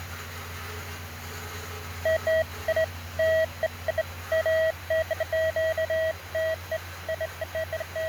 Beeps of irregular length, with radio static and the noise of a restroom. There is no code.